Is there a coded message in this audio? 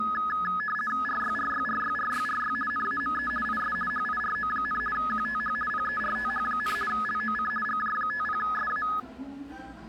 Yes: RTTY (50 baud, 450 Hz shift) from 0.0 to 9.0 s, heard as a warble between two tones, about 1480 Hz centre, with the noise of a crowd indoors. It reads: RYRYRYRYRY NAME IS HIRO, QTH PERTH, LOC GJ50SA